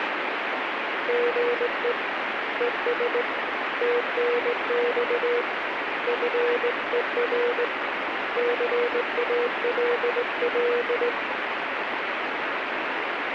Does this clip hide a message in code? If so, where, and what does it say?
Yes: Morse code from 1.0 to 11.2 s, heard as a keyed tone, hand-sent with a straight key, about 18 wpm, 480 Hz, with radio static. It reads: GE ES TNX FER CALL